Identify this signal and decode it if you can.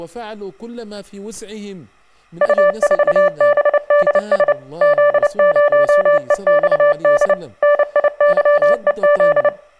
Morse code, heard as a keyed tone, machine-sent, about 29 wpm, 580 Hz, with room echo and speech in Arabic. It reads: U4BDS Z0EXD NIYEZ